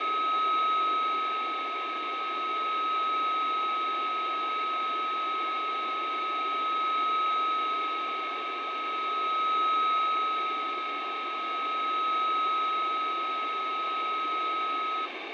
A steady tone, with radio static, fading and room echo. There is no code.